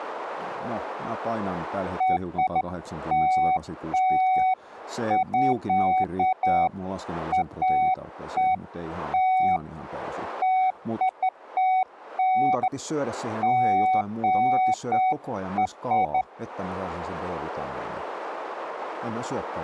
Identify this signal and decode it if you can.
Beeps of irregular length, with speech in Finnish. There is no code.